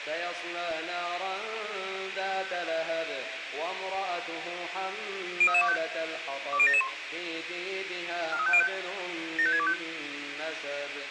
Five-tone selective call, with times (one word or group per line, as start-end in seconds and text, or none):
5.4-5.8 03325
6.5-6.9 20771
8.3-8.7 43505
9.4-9.7 75625